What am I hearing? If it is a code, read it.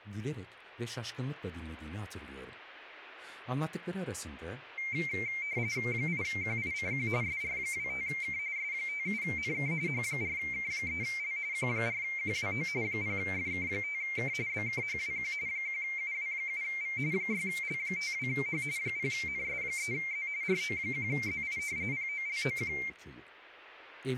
RTTY (45.45 baud, 170 Hz shift), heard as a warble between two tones, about 2200 Hz centre, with speech in Turkish. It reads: 8QICQ SR25K S57NK H4K3L Q4QWO 0FK5K BKHWQ 1UW7V 6L52H 0NS3Z RO1ZI POLOQ